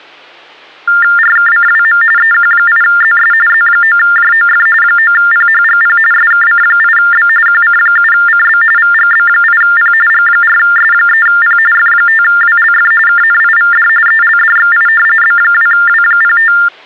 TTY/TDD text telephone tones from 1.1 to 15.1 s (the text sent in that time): RKCWM EQ8ZS Z9JOF 9PHGP SKC8B QC7CB VGB8P G4S3P F5WLF KNIVD ELDXI